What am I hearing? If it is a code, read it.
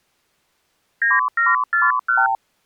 Multi-frequency trunk signalling (R2, with the far end's replies), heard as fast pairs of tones, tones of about 180 ms. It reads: 9741